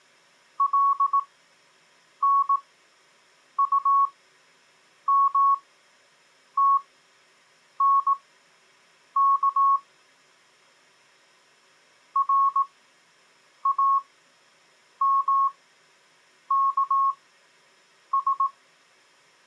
Morse code, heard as a keyed tone, machine-sent, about 18 wpm, spaced as for 7 wpm, 1100 Hz. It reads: LNUMTNK RAMKS